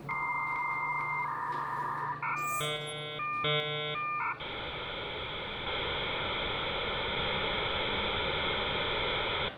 Dial-up modem handshake (V.34 or later), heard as a whistle, warbles, then hiss, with room echo and the noise inside a lift.